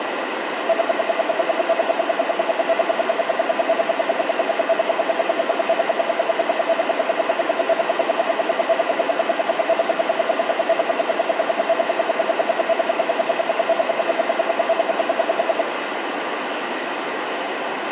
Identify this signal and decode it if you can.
Radio time signal (RWM, Moscow), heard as ten pulses a second, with radio static.